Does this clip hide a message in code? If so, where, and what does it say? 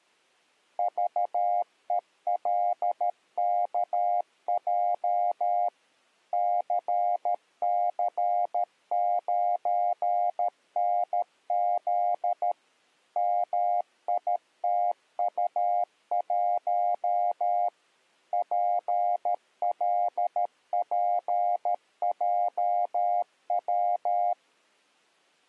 Yes: Morse code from 0.7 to 24.4 s, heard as a keyed tone, machine-sent, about 13 wpm, 710 Hz. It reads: VELKJ CC9NZ MITU1 PLPJW